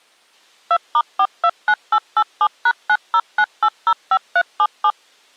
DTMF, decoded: 2*429887#909805377

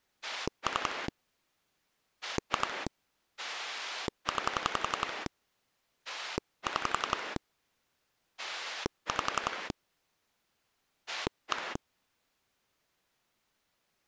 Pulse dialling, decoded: 3 2 9 6 5 1

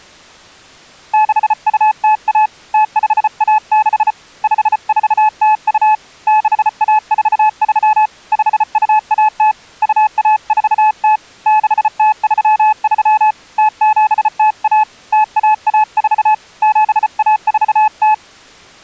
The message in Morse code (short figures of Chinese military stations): 6201 0516 5402 6143 5210 2140 6033 0701 0114 7140

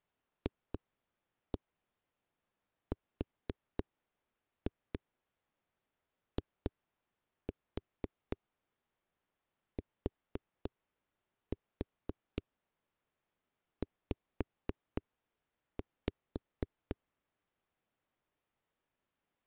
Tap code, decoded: FRITZ

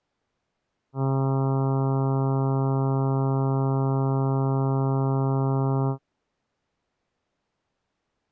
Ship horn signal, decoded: 1 long

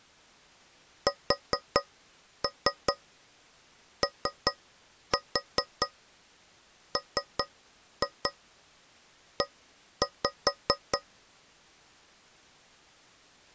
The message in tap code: SOME

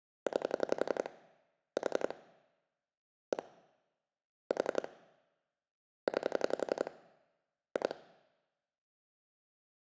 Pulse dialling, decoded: 9 4 1 4 9 2

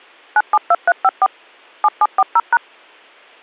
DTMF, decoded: 972354 7740#

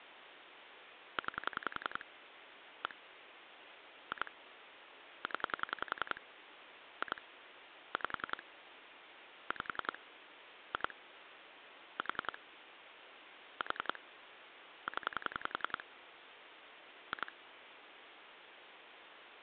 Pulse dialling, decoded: 9 1 2 0 2 5 5 2 4 4 0 2

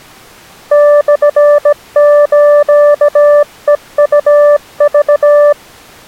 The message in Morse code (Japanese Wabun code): モスヘウク

